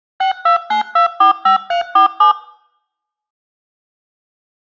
DTMF, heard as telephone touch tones, dialled by machine, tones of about 110 ms. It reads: 629245347